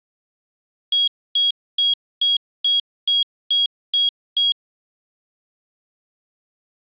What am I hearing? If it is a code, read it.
Beep code, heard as a piezo beeper, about 3300 Hz. 9 short. In AMI BIOS tables: ROM checksum failure.